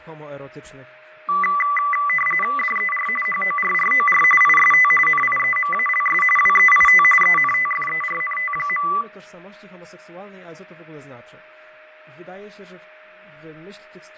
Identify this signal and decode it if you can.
RTTY (45.45 baud, 850 Hz shift), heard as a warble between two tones, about 1600 Hz centre, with fading, a steady whistle near 620 Hz and speech in Polish. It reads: DER HORROR IST NIEMALS WEIT ENTFERNT.